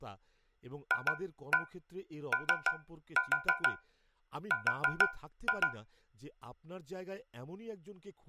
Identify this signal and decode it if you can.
Tap code, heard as taps on a metal pipe, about 6 knocks a second, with speech in Bangla. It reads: FOR